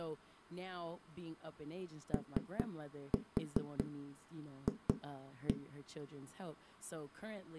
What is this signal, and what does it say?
Tap code, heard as knocks on a wall, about 4 knocks a second, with speech in English. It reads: OF